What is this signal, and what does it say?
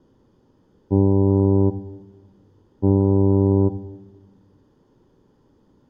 Ship horn signal, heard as a ship's horn, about 100 Hz, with room echo. 2 short. At sea: I am altering course to port.